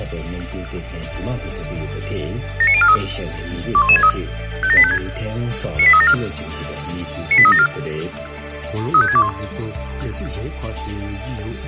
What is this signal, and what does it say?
Five-tone selective call (ZVEI), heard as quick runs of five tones, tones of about 70 ms. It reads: 79043 21163 57856 98374 98374 35621